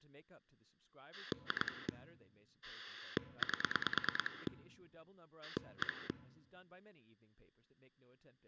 Pulse dialling, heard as a rotary dial, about 9 pulses a second, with speech in English. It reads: 2 8 1